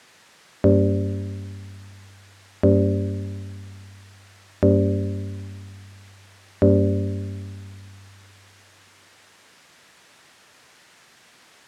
Clock strike, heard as a bell. 4. Four o'clock.